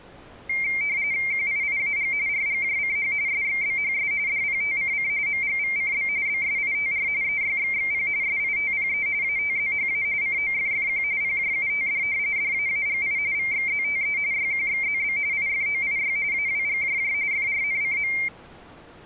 RTTY (45.45 baud, 170 Hz shift), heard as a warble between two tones, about 2200 Hz centre. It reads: QIIAG RGJCH SXBHS DPTCC MGVCB BSITR EYXXP SITPE ATZHA COFFQ PJUTD DAAGI VXZTE YQXZB IFOIY AWGJJ FRNCM